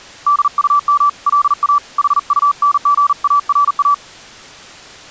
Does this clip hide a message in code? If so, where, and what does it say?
Yes: Morse code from 0.2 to 4.0 s, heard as a keyed tone, hand-sent with a paddle, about 40 wpm, 1160 Hz. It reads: DUM LA HUNGARA